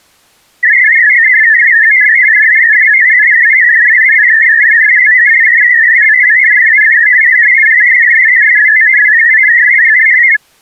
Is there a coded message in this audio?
Yes: multi-tone FSK (Olivia or MFSK type), about 500 Hz wide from 0.6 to 10.4 s, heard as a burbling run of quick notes, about 62.5 baud.